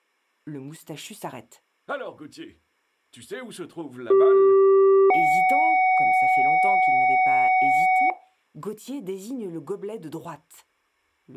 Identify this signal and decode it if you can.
Two-tone page, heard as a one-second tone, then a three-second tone, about 390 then 750 Hz, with speech in French.